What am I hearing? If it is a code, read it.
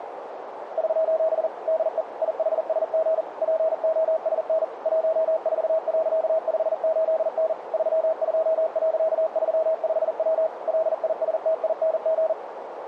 Morse code, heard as a keyed tone, machine-sent, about 40 wpm, 640 Hz, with radio static and a narrow filter. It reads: <SOS> DE IHSG POSN 14.58N 32.35W LISTING